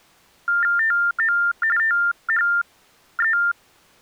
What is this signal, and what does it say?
TTY/TDD text telephone tones (45.45 baud Baudot), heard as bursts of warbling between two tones, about 400 Hz shift, 1600 Hz centre. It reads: TO THE